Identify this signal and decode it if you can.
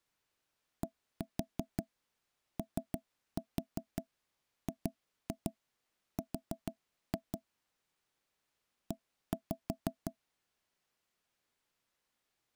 Tap code, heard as knocks on wood, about 6 knocks a second. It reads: DOGR E